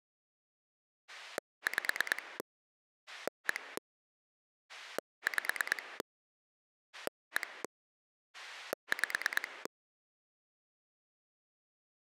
Pulse dialling, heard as a rotary dial, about 9 pulses a second. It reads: 5 1 5 1 5